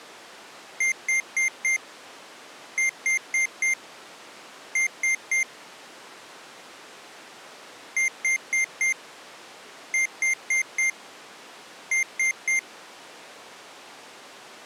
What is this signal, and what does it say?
Beep code, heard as beeps from a small speaker, played twice, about 2100 Hz. 4-4-3. In Phoenix BIOS tables: maths coprocessor failure.